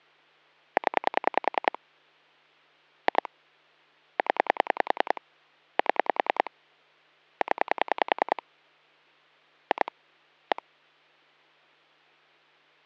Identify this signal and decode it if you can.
Pulse dialling, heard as clicks on a phone line, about 10 pulses a second. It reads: 0 2 0 7 0 2 1